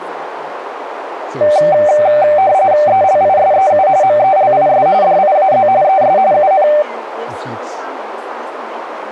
RTTY (45.45 baud, 170 Hz shift), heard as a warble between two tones, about 680 Hz centre, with radio static, a narrow filter and speech in English. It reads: ELISEU MELIS DIAZ ES UN